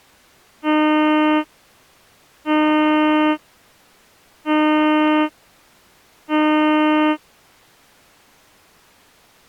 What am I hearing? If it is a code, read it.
Ship horn signal, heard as a ship's horn, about 310 Hz. 4 short. At sea: a pilot vessel's identity signal in fog.